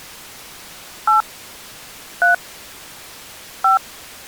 DTMF, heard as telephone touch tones, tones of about 130 ms. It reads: 8 3 5